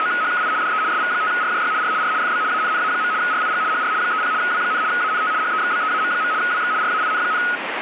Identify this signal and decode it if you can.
RTTY (75 baud, 170 Hz shift), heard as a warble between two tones, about 1360 Hz centre, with radio static. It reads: … DE SV5RJY R R FB ANNA. RIG HR 30 W, ANT HEXBEAM. WX RAIN,